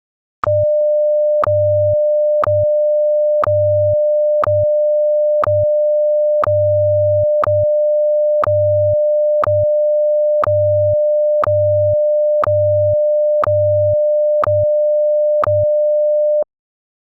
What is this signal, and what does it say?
Radio time signal (WWVH, Hawaii), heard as ticks, one a second.